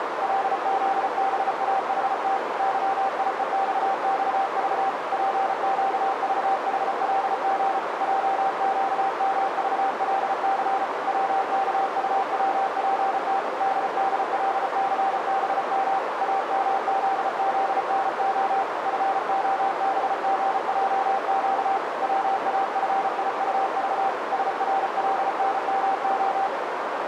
Morse code, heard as a keyed tone, hand-sent with a paddle, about 34 wpm, 780 Hz, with heavy radio static and a narrow filter. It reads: LZBAHT YIEXXV PQVHLG JQMVLC WKUWPT DDLCBM AMZZNO FOBGJQ WAFIUV SRLNMO